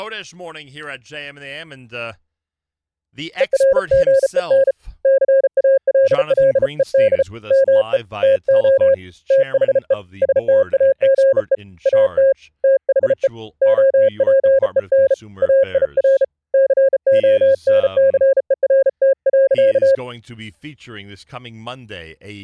Morse code, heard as a keyed tone, hand-sent with a bug key, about 34 wpm, 540 Hz, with speech in English. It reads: ERGEN CALLED ME TO THE STAGE AT THE OPEN AIR CONCERT.